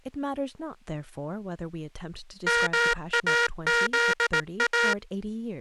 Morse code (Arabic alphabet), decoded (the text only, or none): ماذا